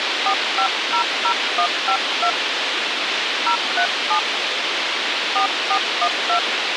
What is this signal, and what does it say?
DTMF, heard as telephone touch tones, dialled by hand, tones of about 80 ms, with radio hiss and a squelch burst at the end. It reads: 4500152 037 4412